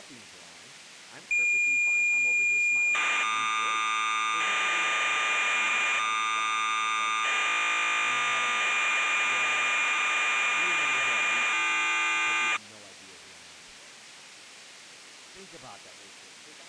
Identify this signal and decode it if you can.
Cassette data (Kansas City type), 1200 baud, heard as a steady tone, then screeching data, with speech in English.